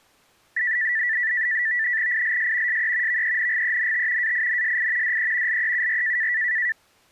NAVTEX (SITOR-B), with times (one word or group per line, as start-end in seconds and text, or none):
2.1-2.8 ILS
2.7-3.2 SE
3.1-4.3 VENGENT
4.2-5.2 AINSI
5.0-5.6 DE
5.5-6.3 LEUR